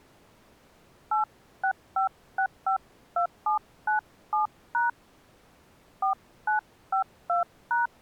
DTMF, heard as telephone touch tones, dialled by hand, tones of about 120 ms. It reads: 865652797# 4952#